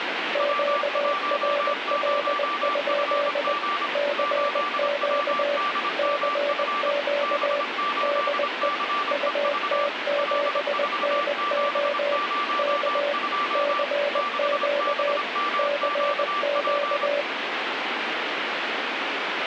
Morse code, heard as two keyed tones, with radio static. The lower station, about 20 wpm, 580 Hz: QRL? CQ CQ DE UT7NO K CQ CQ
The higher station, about 26 wpm, 1170 Hz: W10FG 8WDMF B8CEV L4702 6BMQP